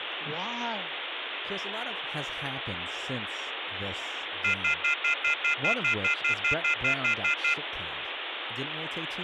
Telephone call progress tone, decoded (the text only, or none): off-hook warning tone